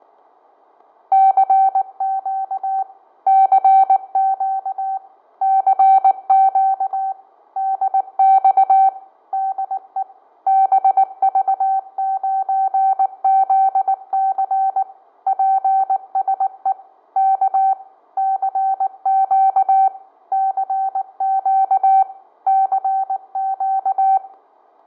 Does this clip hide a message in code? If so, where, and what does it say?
Yes: Morse code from 1.1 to 24.2 s, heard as a keyed tone, machine-sent, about 19 wpm, 770 Hz, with fading, static crashes and room echo. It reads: CQ CQ CQ DX DE BV9ZC PSE K CQ CQ CQ